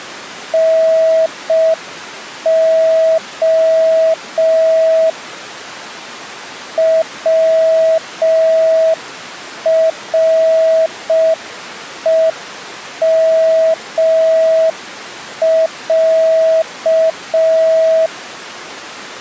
Morse code (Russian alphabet), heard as a keyed tone, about 5 wpm, 650 Hz. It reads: НО ВРЕМЯ